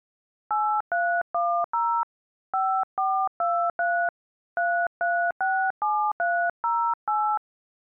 DTMF, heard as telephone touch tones, dialled by hand, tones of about 300 ms. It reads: 8310 5423 3367308